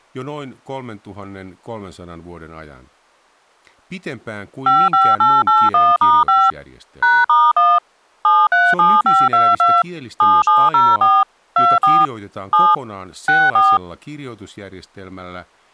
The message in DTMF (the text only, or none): 55881*5 #*1 737522 7704 24 7 64